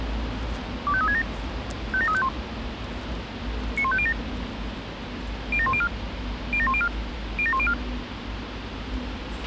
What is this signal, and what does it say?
Five-tone selective call (ZVEI), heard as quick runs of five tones, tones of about 70 ms, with radio hiss, a squelch burst at the end and the noise of a residential street. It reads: 25367 57351 91507 07104 07104 07104